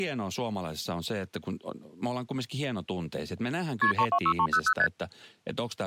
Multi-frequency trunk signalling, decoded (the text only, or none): KP 326300 ST